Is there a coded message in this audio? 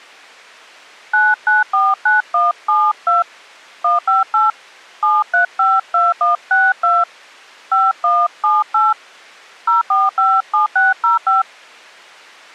Yes: DTMF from 1.1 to 11.4 s, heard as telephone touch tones, dialled by hand, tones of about 170 ms. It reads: 9949172 158 7352162 5178 0457605